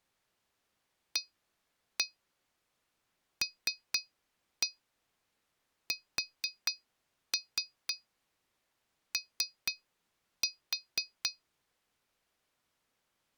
Tap code, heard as taps on glass, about 4 knocks a second. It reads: ALSO